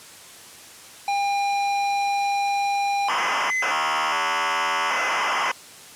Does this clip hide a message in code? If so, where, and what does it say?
Yes: ZX Spectrum tape loading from 1.1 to 5.5 s, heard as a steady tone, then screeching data.